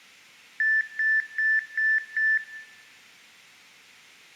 Beep code, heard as beeps, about 1750 Hz, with room echo. 5 short. In AMI BIOS tables: processor failure; in Dell tables: CMOS battery failure.